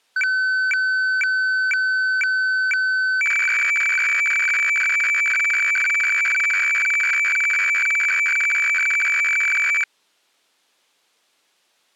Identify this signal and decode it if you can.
Weather fax (radiofax), 120 lines a minute, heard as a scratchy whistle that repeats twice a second.